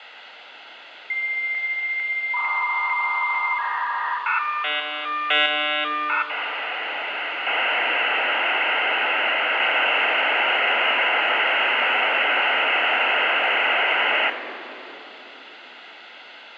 Dial-up modem handshake (V.34 or later), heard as a whistle, warbles, then hiss, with phone line noise and room echo.